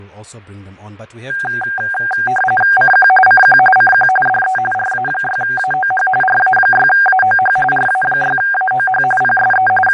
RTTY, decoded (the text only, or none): CQ CQ CQ DE RA6AOH RA6AOH RA6AOH PSE …